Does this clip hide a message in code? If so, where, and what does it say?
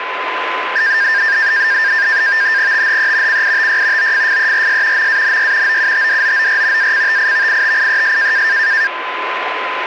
Yes: NAVTEX (SITOR-B), 100 baud, 170 Hz shift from 0.8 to 8.9 s, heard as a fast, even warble, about 1700 Hz centre, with radio static and a steady whistle near 1020 Hz. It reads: THE CITY OFFERS MANY OUTDOOR ACTIVITIES